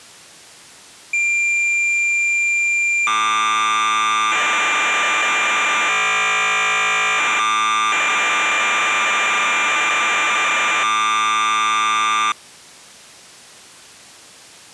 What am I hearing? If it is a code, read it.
Cassette data (Kansas City type), 1200 baud, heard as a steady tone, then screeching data.